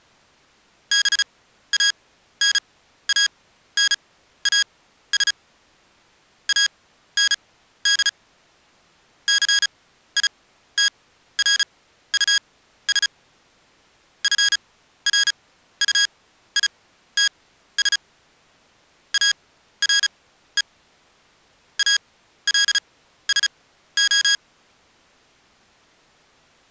Morse code, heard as electronic beeps, machine-sent, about 35 wpm, spaced as for 14 wpm, 1650 Hz. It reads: BANANAS AND CITRUS FRUITS ARE ALSO